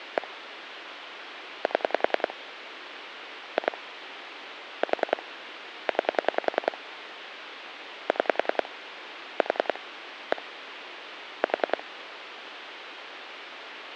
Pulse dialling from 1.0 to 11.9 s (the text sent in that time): 7 2 4 9 6 4 1 4